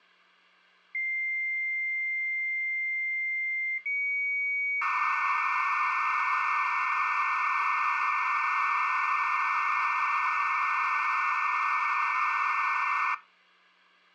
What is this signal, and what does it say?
Dial-up modem handshake (low-speed, two carriers), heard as two whistles, then hiss, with hum.